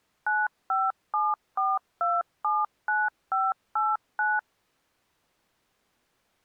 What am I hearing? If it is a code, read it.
DTMF, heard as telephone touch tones, dialled by machine, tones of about 200 ms. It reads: 9574279589